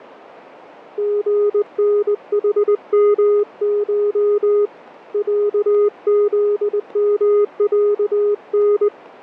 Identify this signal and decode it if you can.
Morse code (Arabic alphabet), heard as a keyed tone, hand-sent with a straight key, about 20 wpm, 410 Hz, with radio static and fading. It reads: غنحمش عذمعن